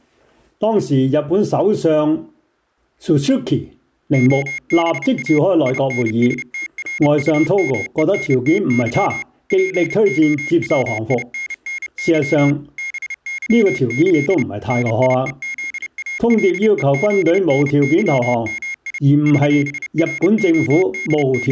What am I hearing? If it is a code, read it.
Morse code (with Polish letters), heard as a high beeper, machine-sent, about 30 wpm, 2150 Hz. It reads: OBA INSTRUMENTY POWINNY BYĆ NIEZALEZNYMI …